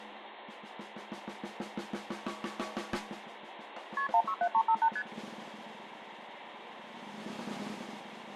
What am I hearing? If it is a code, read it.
Multi-frequency trunk signalling (R1, as on North American trunks), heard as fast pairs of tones, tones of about 70 ms, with phone line noise. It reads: KP 167358 ST